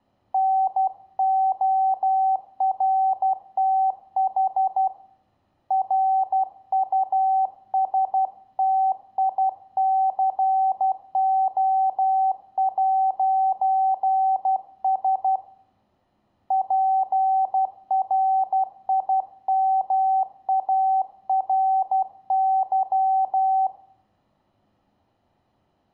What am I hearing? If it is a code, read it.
Morse code, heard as a keyed tone, hand-sent with a paddle, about 12 wpm, 770 Hz, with room echo. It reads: NORTH RUSTICO'S PRIMARY